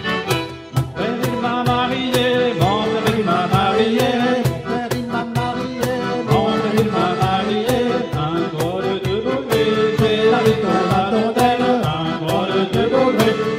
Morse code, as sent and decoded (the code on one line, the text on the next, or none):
none